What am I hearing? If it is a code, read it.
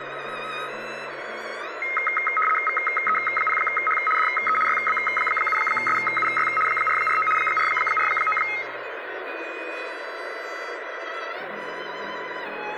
RTTY (75 baud, 850 Hz shift), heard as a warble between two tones, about 1700 Hz centre, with radio static. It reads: VE0H DE YB7SUY 449 449